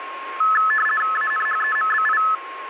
RTTY (50 baud, 450 Hz shift), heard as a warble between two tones, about 1500 Hz centre, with radio static and a steady whistle near 1080 Hz. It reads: ANHEMBI